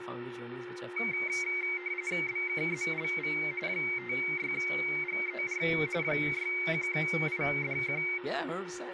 RTTY (45.45 baud, 170 Hz shift), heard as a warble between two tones, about 2200 Hz centre, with radio static, a steady whistle near 360 Hz and speech in English. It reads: BKZLV 56GER 61IDQ